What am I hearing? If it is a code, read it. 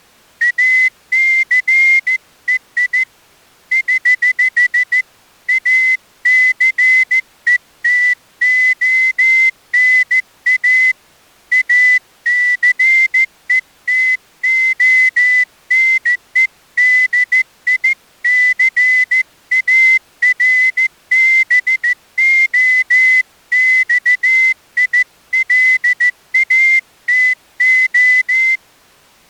Morse code, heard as a whistle, hand-sent with a straight key, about 14 wpm. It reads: ACEI <HH> ACETONA ACETONEDICARBOXILATO